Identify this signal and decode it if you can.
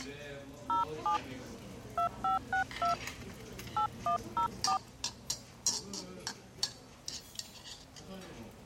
DTMF, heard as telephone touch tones, dialled by hand, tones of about 110 ms, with the noise of a restaurant. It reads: 07 2562 8104